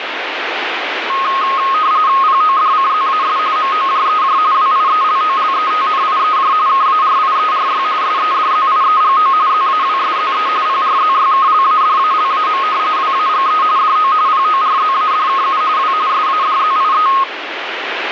RTTY (45.45 baud, 170 Hz shift), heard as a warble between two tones, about 1170 Hz centre, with radio static. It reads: PODCZAS MOJEJ WIELOLETNIEJ KARIERY SEDZIEGO ZAWSZE PRZYKLADALAM WAGE DO PORZADKU W SADZIE